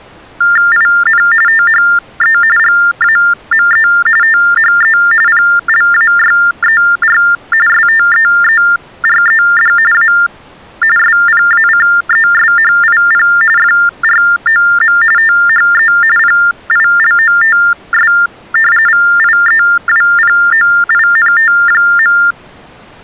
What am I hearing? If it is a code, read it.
TTY/TDD text telephone tones (45.45 baud Baudot), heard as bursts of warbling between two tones, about 400 Hz shift, 1600 Hz centre. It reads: IN THE GAME THE PLAYER STEERED A SPACESHIP FROM THE PILOTS VIEWPOINT.